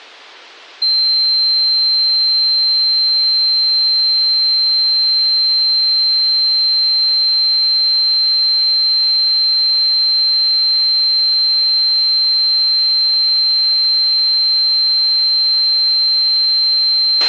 A steady tone, with a squelch burst at the end. There is no code.